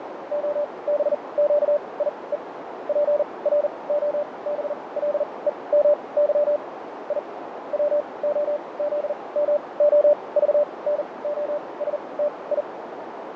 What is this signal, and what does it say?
Morse code (Russian alphabet), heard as a keyed tone, machine-sent, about 40 wpm, spaced as for 25 wpm, 590 Hz, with radio static, fading and a narrow filter. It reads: ОБЩИЕ ПРОБЛЕМЫ И ВОЗМОЖНОСТИ